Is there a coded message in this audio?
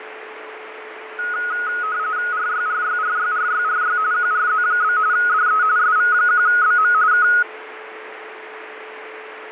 Yes: RTTY (45.45 baud, 170 Hz shift) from 1.2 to 7.4 s, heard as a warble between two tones, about 1360 Hz centre, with radio static, fading and a steady whistle near 440 Hz. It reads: RYRYRYRYRY QRZ? DE SV1BM K